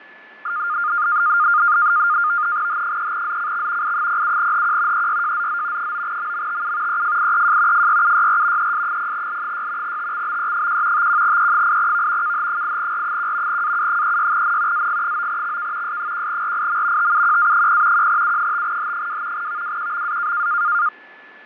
NAVTEX (SITOR-B), 100 baud, 170 Hz shift, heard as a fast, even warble, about 1320 Hz centre, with fading and a steady whistle near 1730 Hz. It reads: H3ZCX I07HQ EYJZZ 9MMTU EFIEJ FYUYR ES0L6 TXBE1 51E8V KH8R1 AU36N AG9XK S1RIM TUQA0 1U5H2 VWQMA